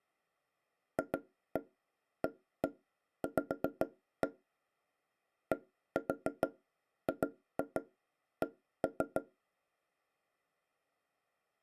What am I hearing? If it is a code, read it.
Tap code, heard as knocks on wood, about 6 knocks a second. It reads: FAV DGC